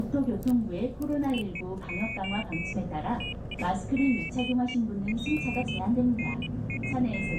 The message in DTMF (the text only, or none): none